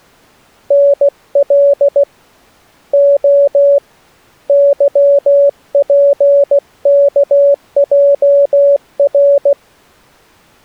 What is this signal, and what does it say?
Morse code, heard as a keyed tone, hand-sent with a paddle, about 16 wpm, 560 Hz. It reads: NL O YPKJR